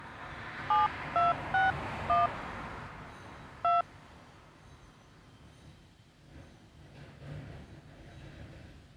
DTMF, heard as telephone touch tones, dialled by hand, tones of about 160 ms, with street noise. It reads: 7261 2